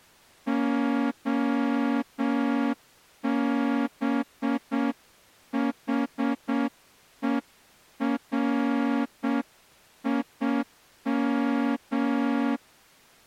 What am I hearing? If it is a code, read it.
Morse code (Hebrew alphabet), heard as a horn, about 7 wpm. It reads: הבחורים